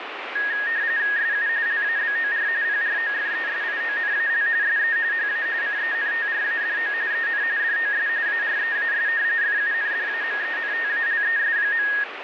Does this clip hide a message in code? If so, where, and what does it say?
Yes: RTTY (45.45 baud, 170 Hz shift) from 0.4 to 12.0 s, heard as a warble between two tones, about 1750 Hz centre, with radio static. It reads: SU LABOR PROFESIONAL SE HA CENTRADO EN DOS AREAS FUNDAMENTALES.